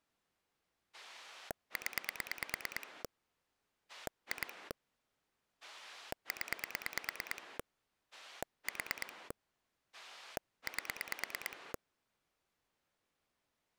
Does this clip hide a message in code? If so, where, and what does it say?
Yes: pulse dialling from 0.9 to 11.8 s, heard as a rotary dial, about 9 pulses a second. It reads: 0 2 0 4 8